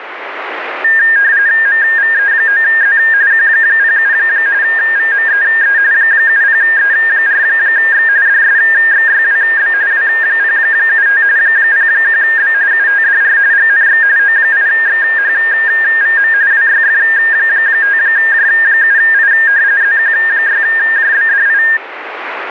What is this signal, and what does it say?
RTTY (45.45 baud, 170 Hz shift), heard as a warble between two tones, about 1700 Hz centre, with radio static. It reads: MVE9Z Q07 VMEE 70E4X DSXYWB W075 01B UTDR GNX O8XHVM WYF5J7I ZQ6JBDI